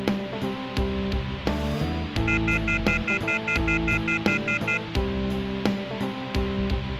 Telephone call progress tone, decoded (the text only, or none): off-hook warning tone